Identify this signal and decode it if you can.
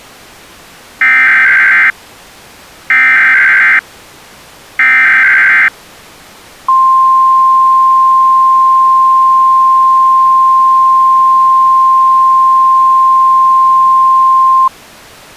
Emergency Alert System (SAME) tones (header bursts, then the 1050 Hz attention tone), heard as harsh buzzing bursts, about 520.83 baud.